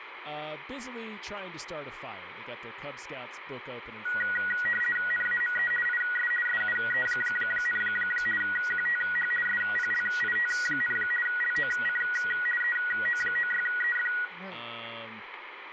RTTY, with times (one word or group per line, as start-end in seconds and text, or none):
5.1-5.7 NAME
5.9-6.3 IS
6.5-7.8 SUE,
8.4-9.3 QTH
9.5-11.0 SPLIT,
11.3-12.0 LOC
12.6-14.1 EO96EF